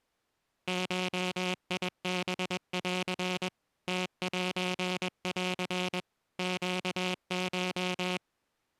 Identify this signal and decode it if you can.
Morse code (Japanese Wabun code), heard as a buzzer, machine-sent, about 21 wpm. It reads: ゴハン ムセン ネコ